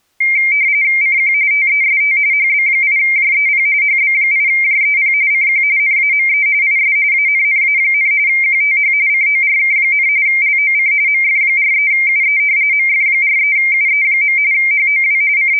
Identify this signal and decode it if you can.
RTTY (45.45 baud, 170 Hz shift), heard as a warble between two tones, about 2200 Hz centre. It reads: CQ TEST HB8JEP HB8JEP CQ NAME IS ANNA, QTH CORK, LOC MF43UE MF43UE. HOW …